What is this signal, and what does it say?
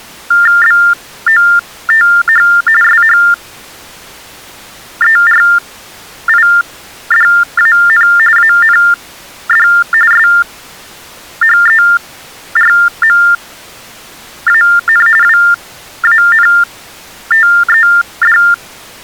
TTY/TDD text telephone tones (45.45 baud Baudot), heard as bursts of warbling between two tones, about 400 Hz shift, 1600 Hz centre. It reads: BOTH SHERIDAN AND SHERMAN WANTED